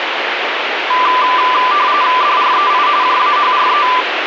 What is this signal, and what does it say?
RTTY (45.45 baud, 170 Hz shift), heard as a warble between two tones, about 1090 Hz centre, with radio static. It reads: DREI JAHRE